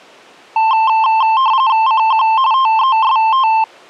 RTTY (45.45 baud, 170 Hz shift), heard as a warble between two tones, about 970 Hz centre. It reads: CQ TEST